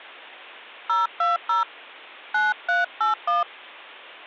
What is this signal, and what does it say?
DTMF, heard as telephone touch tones, dialled by hand, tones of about 150 ms. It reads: 020 9381